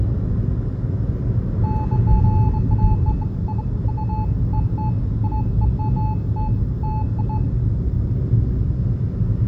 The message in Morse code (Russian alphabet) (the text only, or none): none